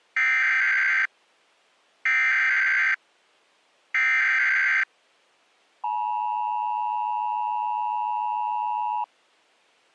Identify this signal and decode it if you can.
Emergency Alert System (SAME) tones (header bursts, then the 853 and 960 Hz attention tone), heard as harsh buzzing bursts, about 520.83 baud.